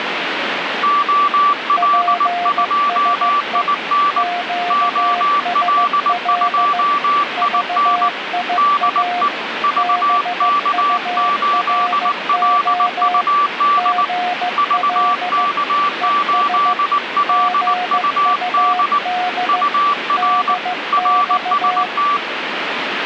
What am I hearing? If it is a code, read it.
Morse code, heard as two keyed tones, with radio static. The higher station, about 19 wpm, 1160 Hz: OL2IN OL2IN DE VK8LUD VK8LUD UR RST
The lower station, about 15 wpm, 720 Hz: PSE QSL VIA BURO GL ES GUD DX